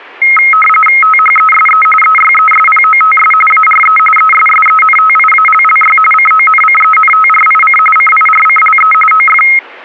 RTTY (45.45 baud, 850 Hz shift), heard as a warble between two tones, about 1700 Hz centre. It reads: THESE EYESPOTS ARE ESSENTIALLY CONCENTRIC CIRCLE OF